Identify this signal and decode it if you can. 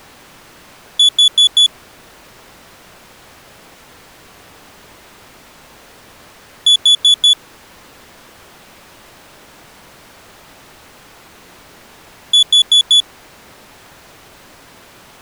Alarm pattern, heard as an alarm's beeps, played three times, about 3450 Hz. Temporal four. Carbon monoxide.